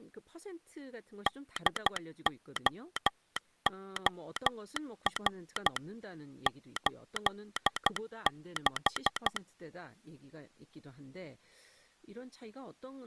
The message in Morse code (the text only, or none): DOOR 86